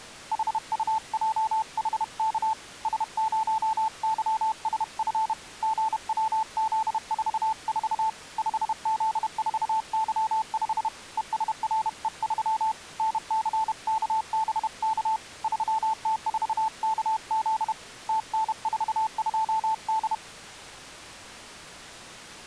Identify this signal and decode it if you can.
Morse code, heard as a keyed tone, hand-sent with a paddle, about 31 wpm, 880 Hz. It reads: HUJHK S0YSF GWZ44 5Z4Y5 ESRE3 NCKBK 3T4KZ TN42D